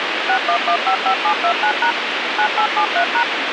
DTMF, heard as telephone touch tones, dialled by machine, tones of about 80 ms, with radio hiss and a squelch burst at the end. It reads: 61155729# 9873#